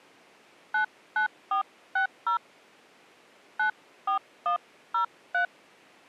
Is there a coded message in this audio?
Yes: DTMF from 0.7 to 5.5 s, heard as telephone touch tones, dialled by hand, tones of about 110 ms. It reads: 99460 94103